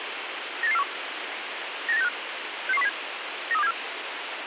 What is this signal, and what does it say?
Five-tone selective call (EEA), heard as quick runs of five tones, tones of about 40 ms, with radio hiss. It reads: 98841 98965 66107 93274